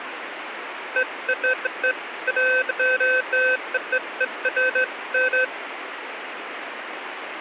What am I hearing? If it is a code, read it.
Beeps of irregular length, with radio static. There is no code.